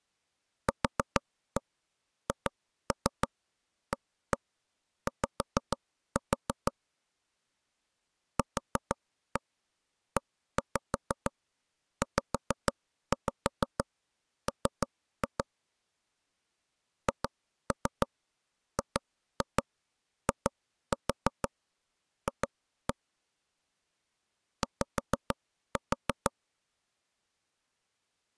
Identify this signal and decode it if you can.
Tap code, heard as knocks on wood, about 6 knocks a second. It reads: QHAY QEZM HGIF Y